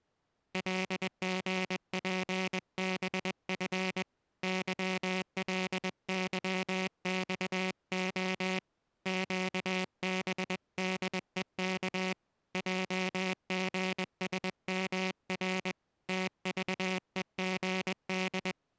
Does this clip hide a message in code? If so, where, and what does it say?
Yes: Morse code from 0.5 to 18.6 s, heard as a buzzer, hand-sent with a paddle, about 21 wpm. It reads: LGPBF YLYXO QBDEK JGSMR TVEGD